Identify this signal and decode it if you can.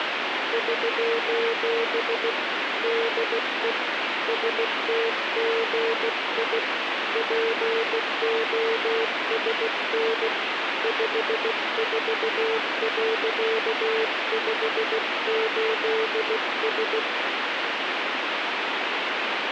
Morse code, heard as a keyed tone, hand-sent with a bug key, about 16 wpm, 450 Hz, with radio static. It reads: <SOS> DE STGI POSN 54.58S